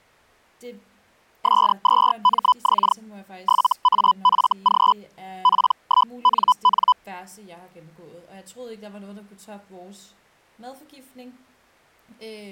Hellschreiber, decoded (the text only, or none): S2MX 7AFG P1NN